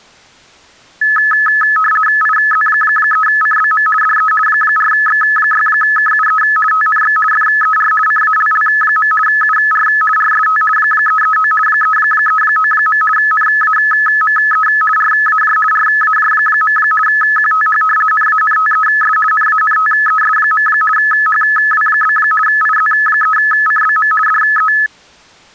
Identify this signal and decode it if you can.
RTTY (50 baud, 450 Hz shift), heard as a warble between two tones, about 1500 Hz centre. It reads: IZ3CBM DE 4X6KUE TNX FER CALL. UR RST 339 339. NAME RAJ RAJ. QTH NANTES NANTES. HW? IZ3CBM DE